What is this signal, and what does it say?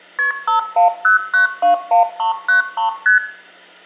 Multi-frequency trunk signalling (R1, as on North American trunks), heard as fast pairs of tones, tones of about 120 ms, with room echo. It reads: KP 510921393 ST